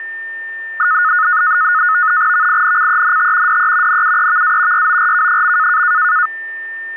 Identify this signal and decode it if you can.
NAVTEX (SITOR-B), 100 baud, 170 Hz shift, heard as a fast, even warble, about 1360 Hz centre, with a steady whistle near 1800 Hz. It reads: VINCENT DE NUEVA YORK.